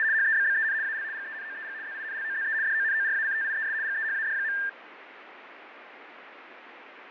RTTY (75 baud, 170 Hz shift), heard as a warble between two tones, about 1700 Hz centre, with radio static and fading. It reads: … HEBBEN AL GENOEG ZINLOZE DONORACTIES GEHAD.